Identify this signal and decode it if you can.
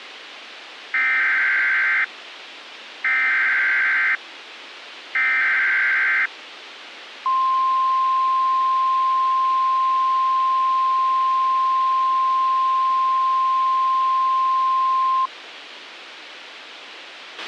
Emergency Alert System (SAME) tones (header bursts, then the 1050 Hz attention tone), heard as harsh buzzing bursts, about 520.83 baud, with radio hiss and a squelch burst at the end.